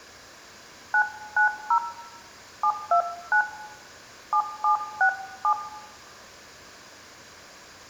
DTMF, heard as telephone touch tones, dialled by hand, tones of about 90 ms, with room echo. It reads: 990 729 7767